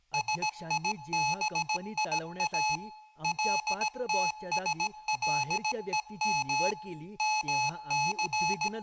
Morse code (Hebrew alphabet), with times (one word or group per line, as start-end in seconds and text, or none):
0.1-2.8 שיביא
3.2-6.7 לתשלום
7.2-8.7 מס